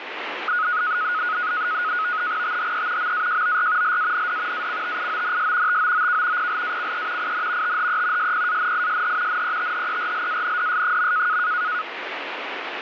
NAVTEX (SITOR-B), 100 baud, 170 Hz shift, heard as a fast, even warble, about 1360 Hz centre, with radio static. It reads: THE MAJOR LAND ACTIONS TOOK PLACE IN THE SPANISH NETHERLANDS.